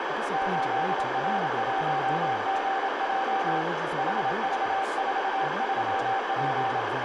Morse code, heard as a keyed tone, hand-sent with a paddle, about 27 wpm, 780 Hz, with heavy radio static, a narrow filter, room echo and speech in English. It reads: 8R1GJ HV43P